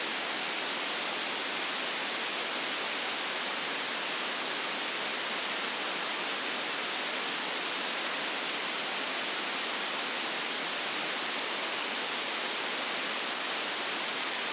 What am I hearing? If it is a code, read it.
A steady tone, with phone line noise. There is no code.